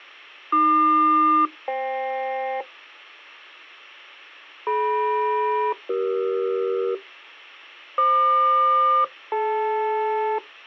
Aircraft SELCAL, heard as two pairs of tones. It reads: AQ-FK DM-CE FQ-DL